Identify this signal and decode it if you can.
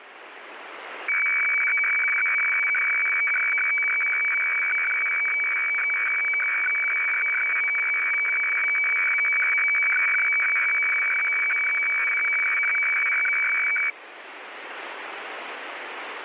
Weather fax (radiofax), 120 lines a minute, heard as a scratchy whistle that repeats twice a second, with radio static.